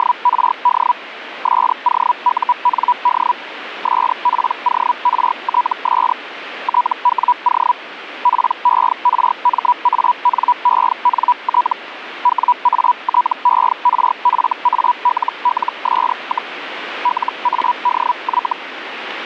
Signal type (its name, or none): Hellschreiber